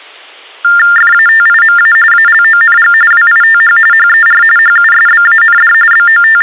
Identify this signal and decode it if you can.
TTY/TDD text telephone tones (45.45 baud Baudot), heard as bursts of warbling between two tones, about 400 Hz shift, 1600 Hz centre. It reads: FATIMA ALONG WITH HER HUSBAND …